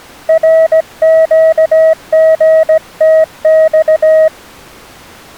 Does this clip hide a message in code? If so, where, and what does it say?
Yes: Morse code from 0.2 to 4.3 s, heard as a keyed tone, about 17 wpm, 640 Hz. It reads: RQGTX